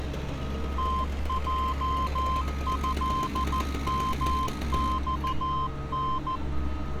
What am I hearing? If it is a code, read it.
Morse code (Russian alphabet), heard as a keyed tone, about 14 wpm, 1040 Hz, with street noise. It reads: ТЙЭМЬН